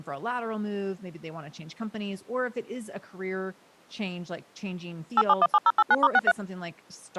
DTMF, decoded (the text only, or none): 8717089*63